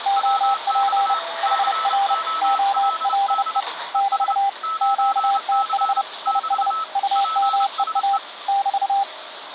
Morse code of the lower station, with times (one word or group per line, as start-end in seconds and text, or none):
0.1-1.1 OP
1.4-2.1 HR
2.4-3.6 OLE
3.9-4.5 <BT>
4.8-6.0 QTH
6.3-6.7 IS
7.0-8.2 UMEA
8.5-9.0 <BT>